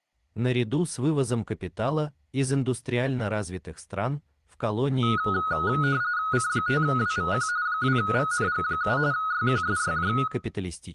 RTTY (45.45 baud, 170 Hz shift), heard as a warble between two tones, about 1360 Hz centre, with room echo. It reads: C5WVQ 2VNG7 YQSYJ